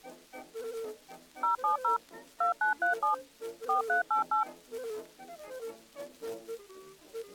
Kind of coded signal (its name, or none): DTMF